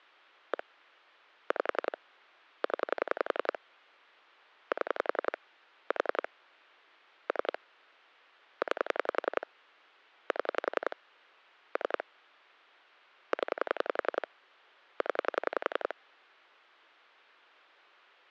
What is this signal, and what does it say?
Pulse dialling, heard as clicks on a phone line, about 11 pulses a second. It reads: 1 5 0 7 4 3 9 7 3 0 0